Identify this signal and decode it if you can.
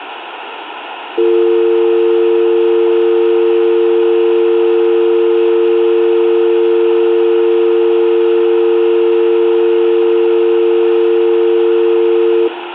Telephone call progress tone (North American or UK plan), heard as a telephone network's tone, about 350, 450 Hz, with phone line noise and room echo. Dial tone.